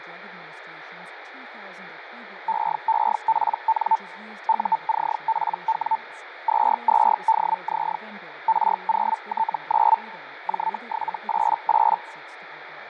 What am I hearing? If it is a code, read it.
Hellschreiber (Feld-Hell, 122.5 baud), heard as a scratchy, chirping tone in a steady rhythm, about 890 Hz, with radio static, fading and speech in English. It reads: EEPN UCPW 22DZ R0T9 J788